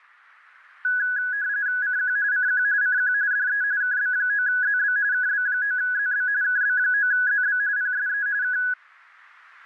RTTY (45.45 baud, 170 Hz shift), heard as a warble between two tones, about 1600 Hz centre. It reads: CQ CQ CQ DE KB9ZB KB9ZB KB9ZB PSE K